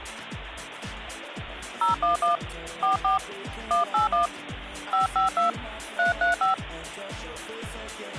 DTMF, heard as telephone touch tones, dialled by hand, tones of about 130 ms, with phone line noise. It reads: 011 44 181 552 335